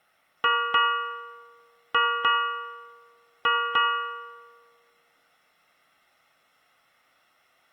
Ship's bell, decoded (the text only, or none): 6